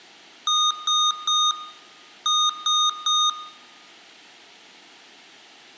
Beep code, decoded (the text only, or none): 3-3